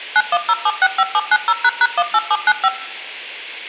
DTMF, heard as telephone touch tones, dialled by machine, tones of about 50 ms. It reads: 910765790##18795